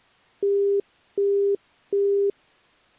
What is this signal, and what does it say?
Telephone call progress tone (as in the UK, Australia and similar networks), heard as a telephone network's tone, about 400 Hz, 0.375 s on and 0.375 s off. Busy tone.